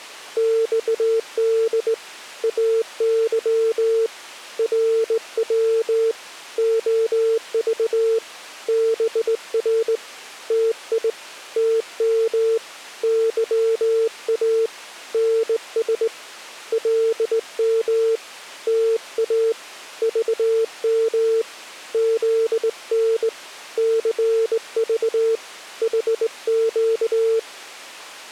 Morse code, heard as a keyed tone, hand-sent with a straight key, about 19 wpm, 450 Hz. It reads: XD AY RW OV BR TI TM YA NS LM TA VM ZN CV HQ